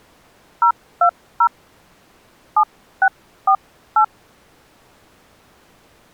DTMF, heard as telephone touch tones, dialled by hand, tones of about 80 ms. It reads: 020 7648